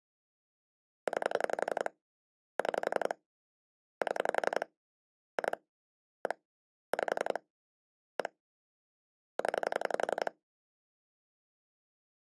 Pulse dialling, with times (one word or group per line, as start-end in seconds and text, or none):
1.1-1.9 9
2.6-3.1 6
4.0-4.7 7
5.4-5.6 2
6.3-6.3 1
6.9-7.4 5
8.2-8.3 1
9.4-10.3 0